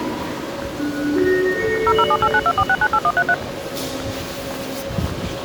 DTMF, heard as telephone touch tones, dialled by machine, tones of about 60 ms, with the noise of a subway station. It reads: 0078924698133